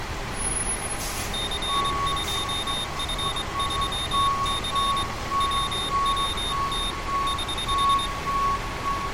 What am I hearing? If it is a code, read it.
Morse code, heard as a high beeper, hand-sent with a straight key, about 23 wpm, 3650 Hz, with street noise. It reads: C2F3C WWT <HH>